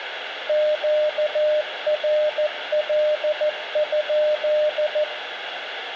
Morse code, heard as a keyed tone, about 14 wpm, 610 Hz, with radio static and room echo. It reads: QRL?